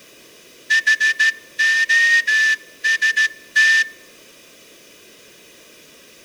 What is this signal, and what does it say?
Morse code, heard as a whistle, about 14 wpm. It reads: HOST